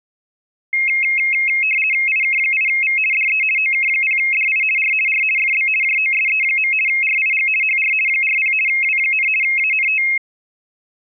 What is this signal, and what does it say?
RTTY (50 baud, 450 Hz shift), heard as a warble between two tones, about 2350 Hz centre. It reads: IK8V DE OK0DI R R FB JOSE. RIG HR 40 W, ANT